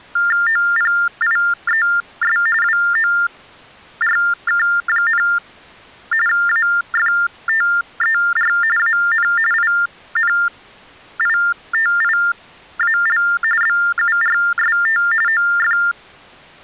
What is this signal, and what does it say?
TTY/TDD text telephone tones (45.45 baud Baudot), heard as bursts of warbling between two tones, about 400 Hz shift, 1600 Hz centre. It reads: OPIES WORK, AFTER AN INITIAL BURST OF